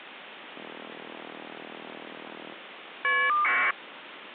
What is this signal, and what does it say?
Caller ID data burst, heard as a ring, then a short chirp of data, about 1200 baud, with phone line noise.